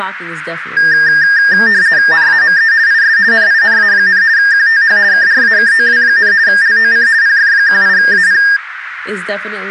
RTTY (50 baud, 170 Hz shift), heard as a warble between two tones, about 1700 Hz centre, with radio static and speech in English. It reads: NAME IS NINA, QTH KRAKOW, LOC PF18AP